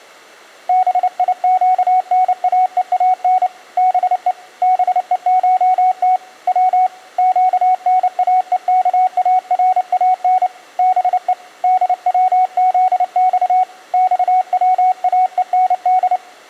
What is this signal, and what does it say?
Morse code (Persian alphabet), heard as a keyed tone, hand-sent with a paddle, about 29 wpm, 740 Hz. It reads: بیگناهان به بهشت و گناهکاران به دوزخ خواهند